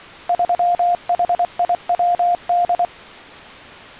Morse code, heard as a keyed tone, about 24 wpm, 700 Hz. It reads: 3HIWD